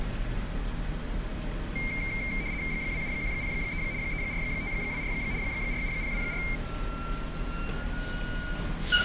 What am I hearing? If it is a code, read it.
RTTY (75 baud, 170 Hz shift), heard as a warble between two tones, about 2200 Hz centre, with street noise. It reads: 27103 34524 47024